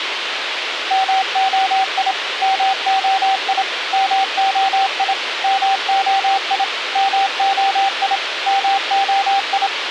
Morse code, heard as a keyed tone, machine-sent, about 27 wpm, 780 Hz, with radio hiss. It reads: MOI MOI MOI MOI MOI MOI